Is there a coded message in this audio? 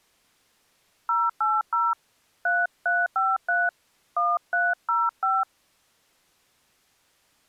Yes: DTMF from 1.1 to 5.4 s, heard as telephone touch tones, dialled by hand, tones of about 210 ms. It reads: 080 3353 1305